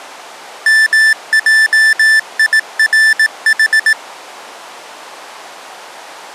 Morse code, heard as electronic beeps, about 18 wpm, 1750 Hz. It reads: MJIRH